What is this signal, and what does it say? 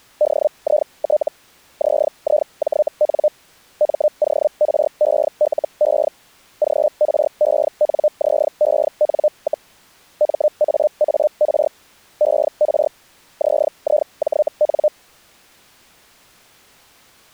Hellschreiber (Feld-Hell, 122.5 baud), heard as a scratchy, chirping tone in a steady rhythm, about 600 Hz. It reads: DIT ZIJN MORELE GRENZEN, MAAR ER ZIJN